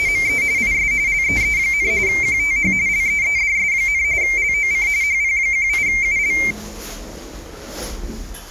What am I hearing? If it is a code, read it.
RTTY (45.45 baud, 170 Hz shift), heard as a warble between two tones, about 2200 Hz centre, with the noise inside a lift. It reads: … IS LEE, QTH LEEDS, LOC HP18UL